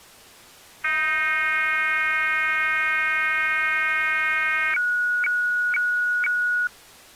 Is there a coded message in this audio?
Yes: weather fax (radiofax), 120 lines a minute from 0.8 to 6.7 s, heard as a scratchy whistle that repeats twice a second.